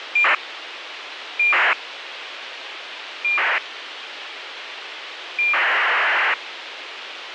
ACARS aircraft data, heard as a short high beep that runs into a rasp, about 2400 baud, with radio hiss.